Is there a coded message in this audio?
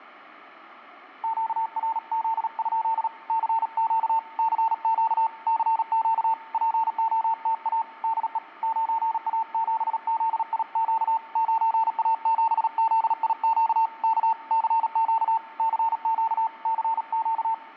Yes: Morse code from 1.2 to 17.6 s, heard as a keyed tone, hand-sent with a paddle, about 37 wpm, 900 Hz. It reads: QRZ? CQ CQ CQ POTA DE 9A7ZIQ 9A7ZIQ K CQ CQ CQ